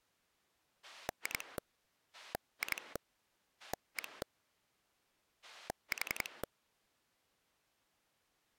Pulse dialling, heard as a rotary dial, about 11 pulses a second. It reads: 2 2 1 4